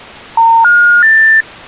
Telephone call progress tone (North American plan), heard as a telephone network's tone, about 910, 1430, 1800 Hz. Special information tone.